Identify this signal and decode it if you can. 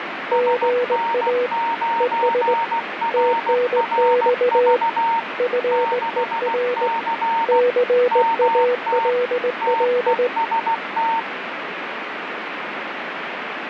Morse code, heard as two keyed tones, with radio static. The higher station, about 16 wpm, 920 Hz: SN9RRV 6C MT TEST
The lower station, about 19 wpm, 490 Hz: GA ES TNX FER CALL